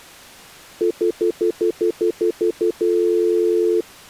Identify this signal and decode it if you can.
Telephone call progress tone (North American plan), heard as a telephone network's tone, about 350, 440 Hz, 0.1 s on and 0.1 s off. Stutter dial tone.